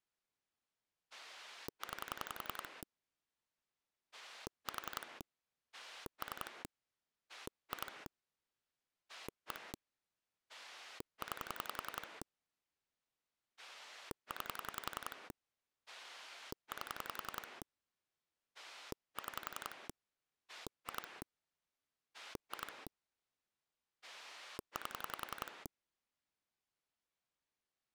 Pulse dialling, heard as a rotary dial, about 11 pulses a second. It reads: 9 4 3 2 1 9 9 8 6 2 2 8